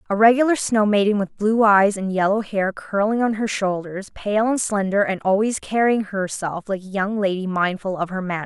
Speech in English. There is no code.